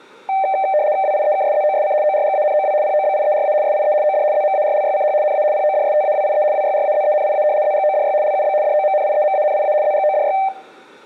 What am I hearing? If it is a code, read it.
RTTY (75 baud, 170 Hz shift), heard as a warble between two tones, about 690 Hz centre, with room echo. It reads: WIEKSZOSC ORGANOW POBIERA SIE OD ZMARLYCH NA PODSTAWIE WYRAZENIA ZGODY LUB DOMNIEMANIA ZGODY